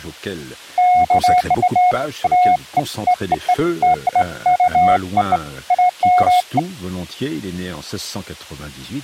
Beeps of irregular length, with speech in French. There is no code.